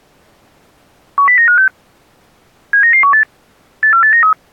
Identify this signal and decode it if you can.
Five-tone selective call (CCIR), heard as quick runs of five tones, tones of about 100 ms. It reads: 10956 79918 84893